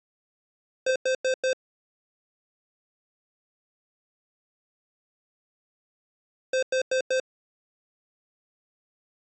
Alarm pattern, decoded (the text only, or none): temporal four